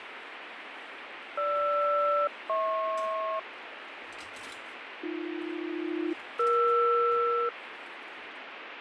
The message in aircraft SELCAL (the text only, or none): GR-HP AB-ER